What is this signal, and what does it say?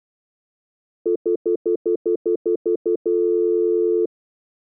Telephone call progress tone (North American plan), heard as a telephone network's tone, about 350, 440 Hz, 0.1 s on and 0.1 s off. Stutter dial tone.